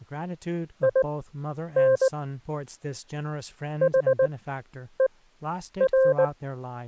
Morse code, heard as a keyed tone, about 19 wpm, spaced as for 9 wpm, 530 Hz, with speech in English. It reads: IN HER